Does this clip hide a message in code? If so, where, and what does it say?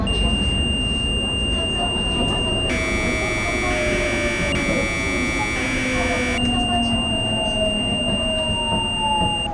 Yes: Commodore tape loading (standard loader) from 0.1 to 9.5 s, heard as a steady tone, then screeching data, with the noise inside a subway train.